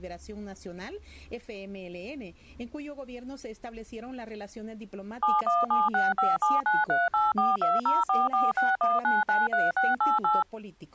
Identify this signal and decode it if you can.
DTMF, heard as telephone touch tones, dialled by machine, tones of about 180 ms. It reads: 7176579384204461993688